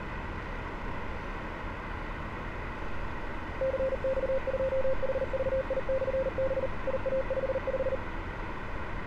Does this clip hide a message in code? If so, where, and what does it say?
Yes: Morse code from 3.5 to 8.0 s, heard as a keyed tone, machine-sent, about 39 wpm, 530 Hz, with radio static and street noise. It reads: CX2HVI/B IA55